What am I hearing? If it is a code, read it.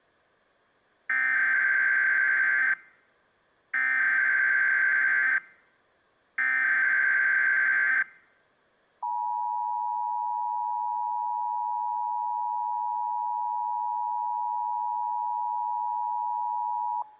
Emergency Alert System (SAME) tones (header bursts, then the 853 and 960 Hz attention tone), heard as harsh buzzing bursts, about 520.83 baud.